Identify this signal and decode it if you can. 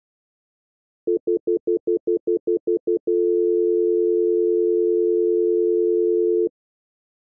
Telephone call progress tone (North American plan), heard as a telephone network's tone, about 350, 440 Hz, 0.1 s on and 0.1 s off. Stutter dial tone.